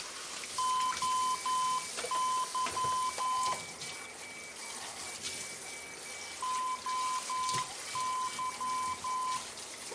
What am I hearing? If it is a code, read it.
Morse code, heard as a keyed tone, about 11 wpm, 1020 Hz, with a weaker station near 2300 Hz, room echo and kitchen noise. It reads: OY OY